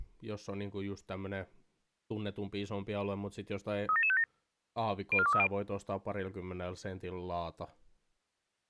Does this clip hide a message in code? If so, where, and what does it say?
Yes: five-tone selective call (ZVEI) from 3.9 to 5.5 s, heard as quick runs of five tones, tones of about 70 ms, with speech in Finnish. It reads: 37757 04230